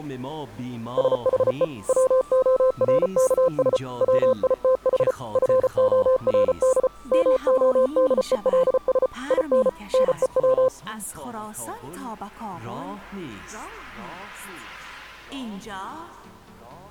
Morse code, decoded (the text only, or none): SHE WORKS WITH FORD MODELS IN NEW